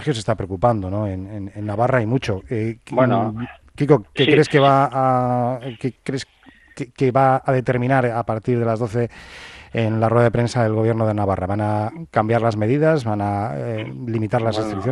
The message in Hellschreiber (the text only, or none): none